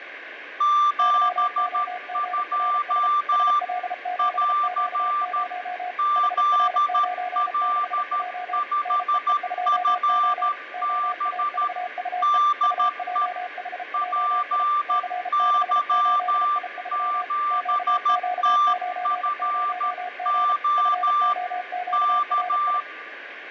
Morse code, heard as two keyed tones, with radio static and fading. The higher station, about 13 wpm, 1180 Hz: 72 <AR> ZL5FB DE PY7TFO K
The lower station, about 33 wpm, 720 Hz: YOGRS SL7Q0 HR96J NEE2O OAVUE UJHJI C68I3 QQ90G FOQRI